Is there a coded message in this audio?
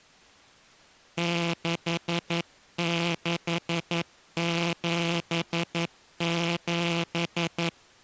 Yes: Morse code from 1.1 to 7.8 s, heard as a buzzer, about 11 wpm. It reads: 6677